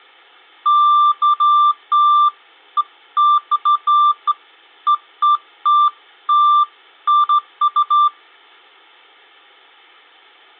Beeps of irregular length. There is no code.